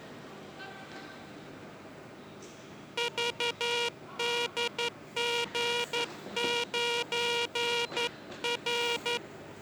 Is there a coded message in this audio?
Yes: Morse code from 2.9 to 9.2 s, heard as a buzzer, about 11 wpm, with the noise of a subway station. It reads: VDG9R